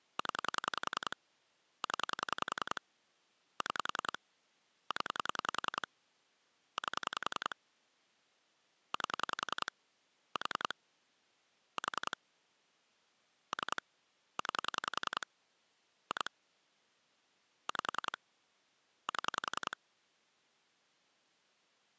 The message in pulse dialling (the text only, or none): 0 0 6 0 8 8 4 4 3 9 2 5 7